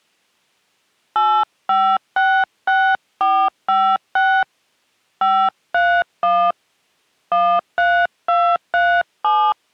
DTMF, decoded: 8566456 531 13237

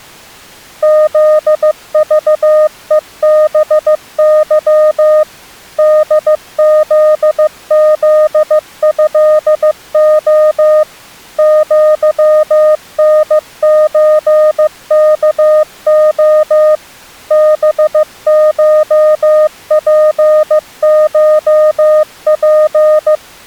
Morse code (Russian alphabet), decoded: ЗЖЕБЫ ДЗЗЭО ЪНЧКО БШПШП

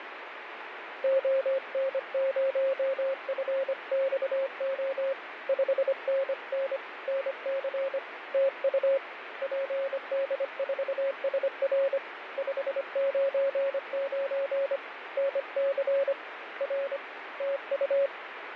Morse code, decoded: ON0FXO 5NN NC TU PD4SR 599 NC R TU

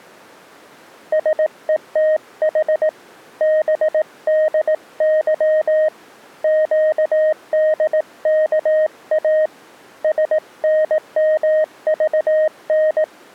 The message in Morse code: SETH BDY QDKA SNMVN

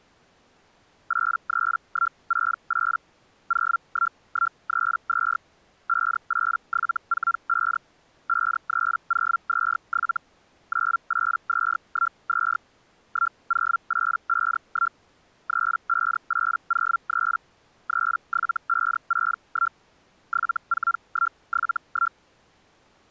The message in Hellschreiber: 83168 01132 58745 53027 98212 10851 35803 37561 74171

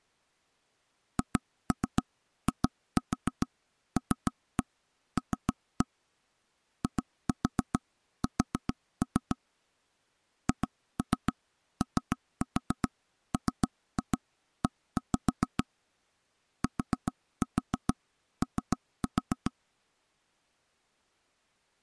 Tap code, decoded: HILL IS HOME TO

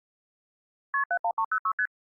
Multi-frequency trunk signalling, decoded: KP 71306 ST

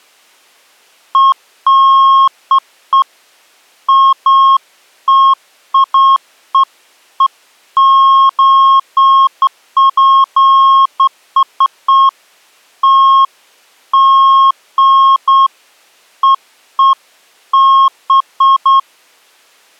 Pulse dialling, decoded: none

